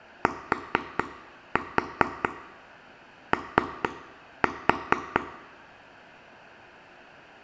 Tap code, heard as taps on a table, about 4 knocks a second, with room echo. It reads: TO